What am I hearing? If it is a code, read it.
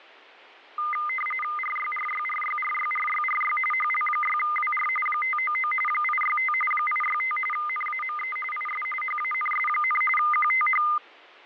RTTY (45.45 baud, 850 Hz shift), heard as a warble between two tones, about 1650 Hz centre, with fading. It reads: RYRYRYRYRYRY HL6WR 599 865 865 NAME IS HANS, QTH